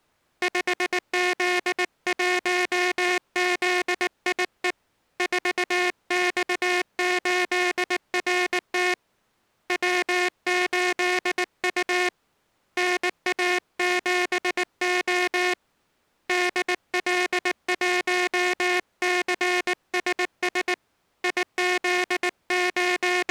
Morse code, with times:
0.4-4.7 5Z1ZIE
5.2-8.9 4X8RT
9.7-12.1 W8U
12.8-15.5 NA7O
16.3-20.7 DL1CSS
21.2-23.3 …

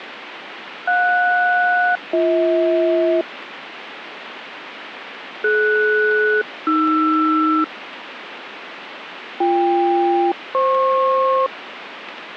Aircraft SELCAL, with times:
0.9-3.2 JS-BH
5.4-7.6 DS-AR
9.4-11.5 BK-FP

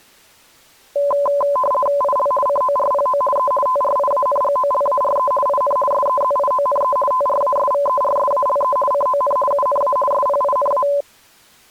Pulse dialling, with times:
none

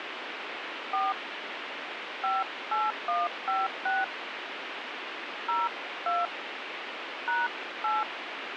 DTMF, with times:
0.9-1.1 4
2.2-4.0 58156
5.5-6.3 02
7.3-8.0 #8

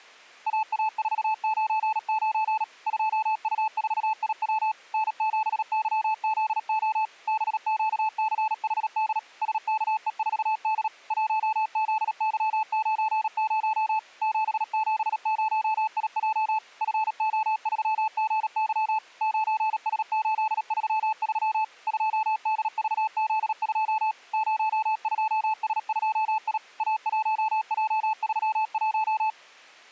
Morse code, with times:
0.5-2.6 AA499
2.9-4.7 2U4IW
4.9-7.0 N7YZO
7.3-9.2 BQCHD
9.4-10.9 SKE4D
11.1-14.0 1ZY90
14.2-16.6 770IJ
16.8-19.0 FO3GY
19.2-21.6 9S833
21.9-24.1 2DVZ2
24.3-26.6 02S2I
26.8-29.3 A1J31

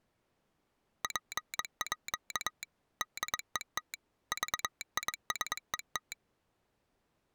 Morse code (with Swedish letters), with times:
1.0-2.6 PÅ
3.0-3.9 DET
4.3-6.1 VISET

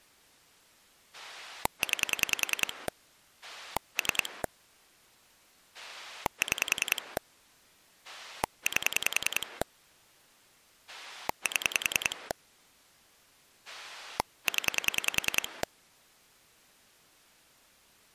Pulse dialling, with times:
1.1-2.9 9
3.4-4.4 3
5.7-7.2 6
8.0-9.6 8
10.9-12.3 7
13.7-15.6 0

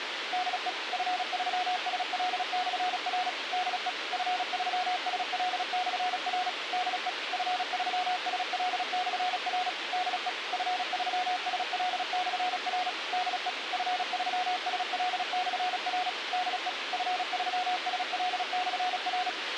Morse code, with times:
0.3-0.7 DE
0.9-3.3 F3SL/R
3.5-3.9 DE
4.1-6.5 F3SL/R
6.7-7.1 DE
7.3-9.7 F3SL/R
9.9-10.3 DE
10.5-12.9 F3SL/R
13.1-13.5 DE
13.7-16.1 F3SL/R
16.3-16.7 DE
16.9-19.3 F3SL/R

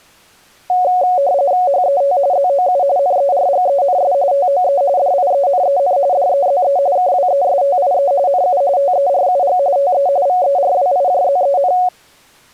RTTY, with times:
1.7-2.2 HET
2.3-2.8 ZOU
3.0-4.1 NERGENS
4.3-4.8 TOE
5.0-6.0 DIENEN
6.1-6.8 DEZE
7.0-8.1 KWESTIE
8.3-8.6 NU
8.8-9.6 TERUG
9.8-10.1 TE
10.3-11.7 VERWIJZEN

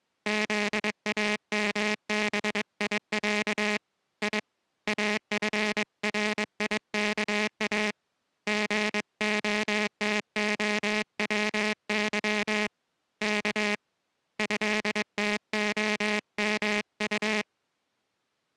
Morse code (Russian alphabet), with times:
0.3-3.8 ЗАМБИЯ
4.2-4.4 И
4.9-7.9 АФРИКА
8.5-12.7 ГОТОВЫ
13.2-13.7 К
14.4-17.4 ЭТОМУ

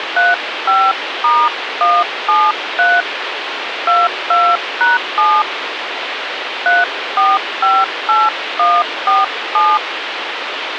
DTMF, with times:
0.2-3.0 35*173
3.9-5.4 22#7
6.7-9.8 3458147

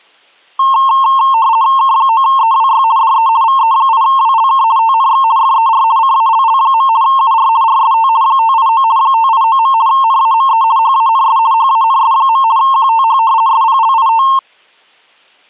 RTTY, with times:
1.8-2.8 K9EWY
3.0-3.3 DE
3.4-4.6 VE8WLK
4.8-5.2 TNX
5.4-5.8 FER
6.0-6.9 CALL.
7.0-7.5 UR
7.6-8.1 RST
8.2-8.8 589
9.0-9.7 589.
9.9-10.6 NAME
10.8-11.4 HANS
11.5-12.4 HANS.
12.6-13.2 QTH
13.5-14.2 SPLIT

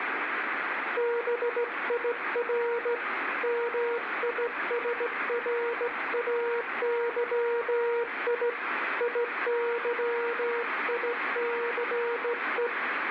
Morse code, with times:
1.0-2.9 BIR
3.4-8.5 MISRAYI
9.0-12.7 IYICE

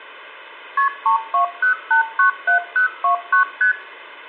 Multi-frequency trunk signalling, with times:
0.8-0.9 KP
1.1-3.4 320897029
3.6-3.7 ST

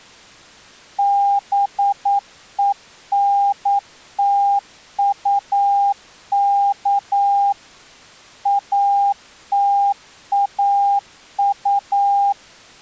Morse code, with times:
1.0-7.5 BENTUK
8.5-12.3 ATAU

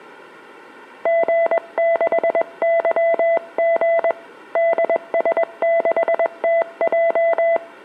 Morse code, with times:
1.1-4.1 G6YG
4.6-7.6 DS6TJ

